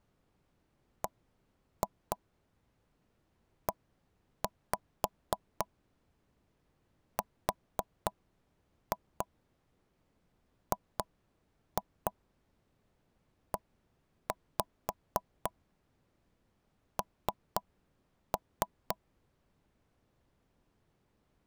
Tap code, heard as taps on a table, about 4 knocks a second. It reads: BERGEN